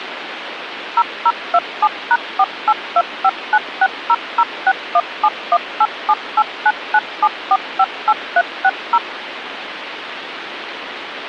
DTMF, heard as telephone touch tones, dialled by machine, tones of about 50 ms, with phone line noise. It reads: 0027#482596006171878997458360